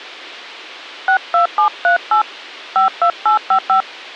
DTMF, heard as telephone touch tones, dialled by hand, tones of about 100 ms. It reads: 62738 52855